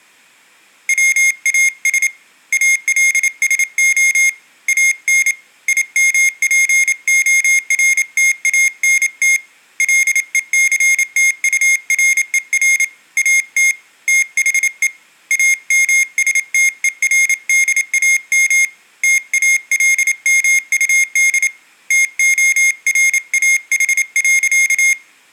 Morse code, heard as a high beeper, hand-sent with a paddle, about 28 wpm, 2150 Hz. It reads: WAS ALSO AN IMPORTANT LECTURER AT THE AMSTERDAM TALMUD TORAH.